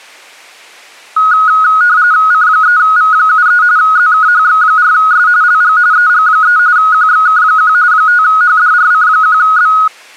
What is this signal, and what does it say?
RTTY (45.45 baud, 170 Hz shift), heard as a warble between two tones, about 1360 Hz centre. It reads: C3V73 ZKHX4S LG EG3 QXK1 5HDRC1B